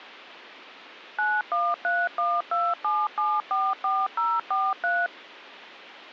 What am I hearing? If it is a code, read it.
DTMF, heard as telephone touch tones, dialled by machine, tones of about 220 ms. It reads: 913127744043